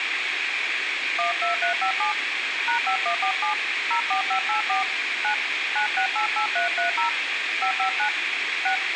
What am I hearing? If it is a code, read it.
DTMF, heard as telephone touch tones, dialled by hand, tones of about 110 ms, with radio hiss. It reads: 12357 #5147 04584 9 9688330 559 6